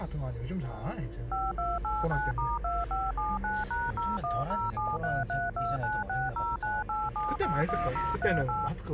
DTMF, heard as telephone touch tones, dialled by machine, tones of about 200 ms, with the noise inside a car. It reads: 5289*2579#010733296098781038